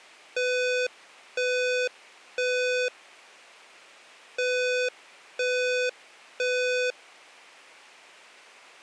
Alarm pattern, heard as an alarm's beeps, played twice, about 500 Hz. Temporal three. Smoke or fire, evacuate.